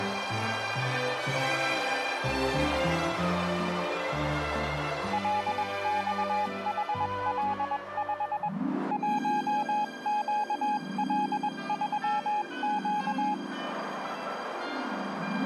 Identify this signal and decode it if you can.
Morse code, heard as a keyed tone, hand-sent with a paddle, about 21 wpm, 840 Hz, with radio static. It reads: LXHL5 1QL3Q